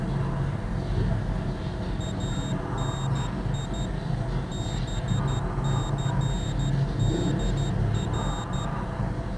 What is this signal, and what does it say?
Morse code (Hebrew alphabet), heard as a high beeper, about 12 wpm, 3700 Hz, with the noise inside a lift. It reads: אני בסדר